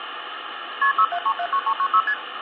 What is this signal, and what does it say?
Multi-frequency trunk signalling (R1, as on North American trunks), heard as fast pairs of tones, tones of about 70 ms, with phone line noise. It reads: KP 67379396 ST